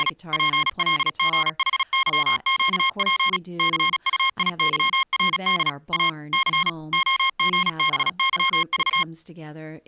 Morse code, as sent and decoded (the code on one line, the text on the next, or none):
… / .--. .-.. --. .... -.-- --.- .--. / -.-. ..- .. -.-- .-. -.. / .- / -.-. / --- --. -... -.-- ...-
… PLGHYQP CUIYRD A C OGBYV